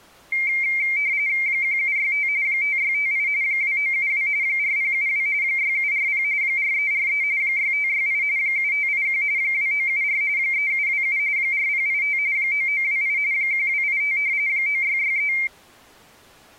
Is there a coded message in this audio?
Yes: RTTY (45.45 baud, 170 Hz shift) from 0.3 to 15.5 s, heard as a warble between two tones, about 2200 Hz centre. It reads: 1765 5658 2972 4072 6740 4343 6568 7581 2974 3727 4085 9928 1285 9663